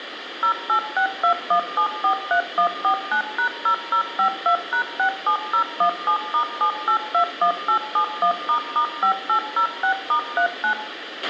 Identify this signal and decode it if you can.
DTMF, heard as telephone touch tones, dialled by machine, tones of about 90 ms, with radio hiss, a squelch burst at the end and room echo. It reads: 08621743149#0052#67017*7821871**5806*39